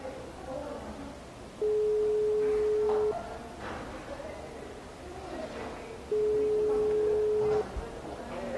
Telephone call progress tone (single-tone plan, as in most of Europe), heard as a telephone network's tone, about 420 Hz, 1.5 s on and 3 s off, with the noise of a crowd indoors. Ringback tone.